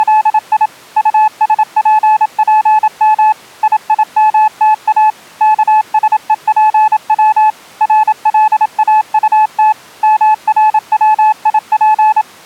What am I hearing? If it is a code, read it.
Morse code, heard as a keyed tone, machine-sent, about 27 wpm, 860 Hz. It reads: … USPPM IIMTA KSEPW RLAUT MRWIP